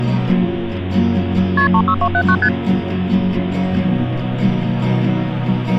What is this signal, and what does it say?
Multi-frequency trunk signalling (R1, as on North American trunks), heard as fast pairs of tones, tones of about 70 ms. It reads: KP 36279 ST